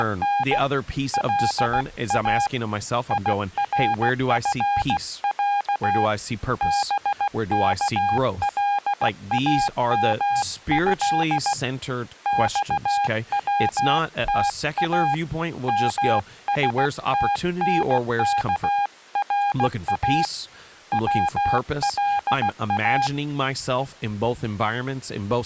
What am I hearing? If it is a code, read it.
Morse code (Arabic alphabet), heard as a keyed tone, hand-sent with a paddle, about 16 wpm, 810 Hz, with speech in English. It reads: … لا يرفع بكلامه صوتا مستنكرا ولا